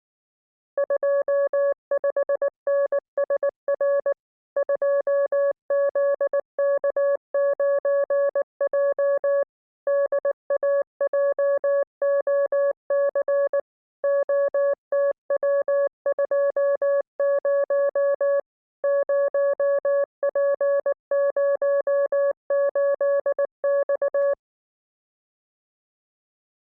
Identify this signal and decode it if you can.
Morse code, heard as a keyed tone, machine-sent, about 19 wpm, 560 Hz. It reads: 25NSR 2ZK9J DAJOC OTW20 0P08X